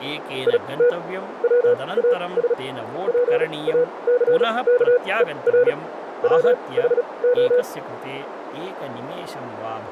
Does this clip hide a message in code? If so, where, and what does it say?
Yes: Morse code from 0.4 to 7.7 s, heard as a keyed tone, machine-sent, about 36 wpm, spaced as for 24 wpm, 490 Hz, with radio static, a narrow filter and speech in Sanskrit. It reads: IT WAS PACKER WHO